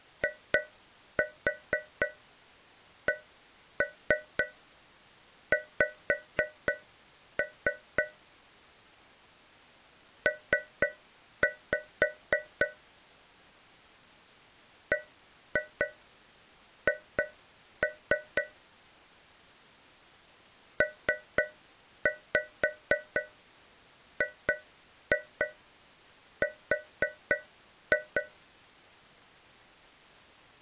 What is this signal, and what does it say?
Tap code, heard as taps on a metal pipe, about 4 knocks a second. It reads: ICX P BH PGR